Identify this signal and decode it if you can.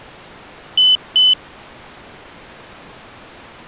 Beep code, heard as a piezo beeper, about 3000 Hz. 2 short. In AMI BIOS tables: memory parity error; in IBM BIOS tables: self-test error shown on screen; in Dell tables: no memory detected.